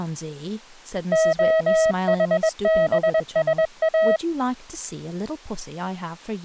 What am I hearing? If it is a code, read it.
Morse code, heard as a keyed tone, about 21 wpm, 640 Hz, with speech in English. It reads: OHBSA